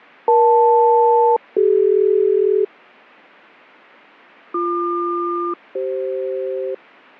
Aircraft SELCAL, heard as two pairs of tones, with fading. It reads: EL-CD BQ-CF